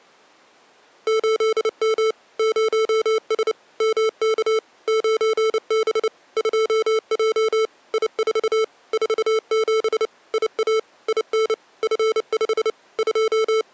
Morse code, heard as electronic beeps, machine-sent, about 29 wpm, 440 Hz. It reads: 8M 0S MK 9B 2J I4 47 IA IN F5 …